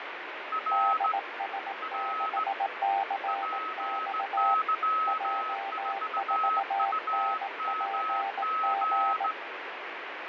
Morse code, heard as two keyed tones, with heavy radio static and fading. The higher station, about 17 wpm, 1280 Hz: R R PY4UMG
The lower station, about 18 wpm, 790 Hz: DS6CX J4NPG